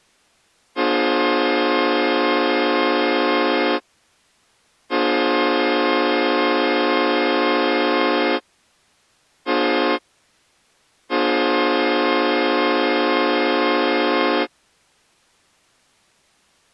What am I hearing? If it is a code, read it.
Train horn signal, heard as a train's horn. 2 long, 1 short, 1 long. On North American railways: approaching a public crossing.